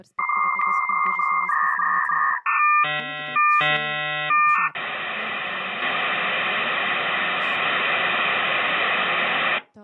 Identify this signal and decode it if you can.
Dial-up modem handshake (V.34 or later), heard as a whistle, warbles, then hiss, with speech in Polish.